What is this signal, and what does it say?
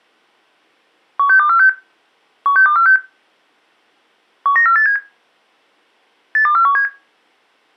Five-tone selective call (CCIR), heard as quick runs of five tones, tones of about 100 ms. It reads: 16246 16246 19487 82417